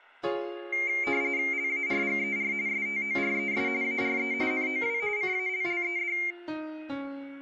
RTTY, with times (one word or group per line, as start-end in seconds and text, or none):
1.5-2.5 LARGER
2.7-3.7 STORES
3.8-4.3 ARE
4.5-5.0 NOW
5.2-6.2 CALLED